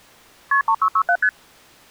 Multi-frequency trunk signalling (R1, as on North American trunks), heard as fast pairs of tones, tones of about 70 ms. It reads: KP 3667 ST